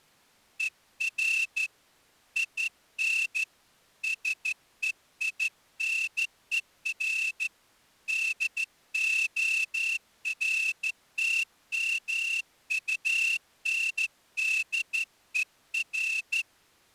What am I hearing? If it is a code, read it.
Morse code, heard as a whistle, hand-sent with a straight key, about 13 wpm. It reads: ER IN SEINER DORTMUNDER